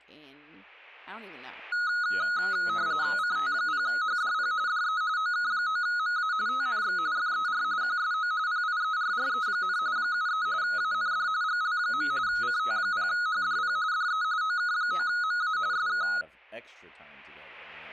RTTY (45.45 baud, 170 Hz shift), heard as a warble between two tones, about 1360 Hz centre, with speech in English. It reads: CT0HDP DE OK9MA TNX FER QSO PIERRE, 73 AND GL. CT0HDP DE OK9MA SK